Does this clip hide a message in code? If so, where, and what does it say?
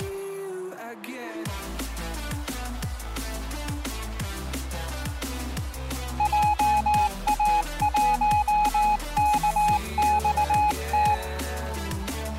Yes: Morse code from 6.1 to 11.2 s, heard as a keyed tone, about 19 wpm, 840 Hz. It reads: JA1KXT